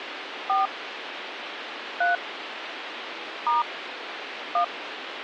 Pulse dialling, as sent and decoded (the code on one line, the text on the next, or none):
none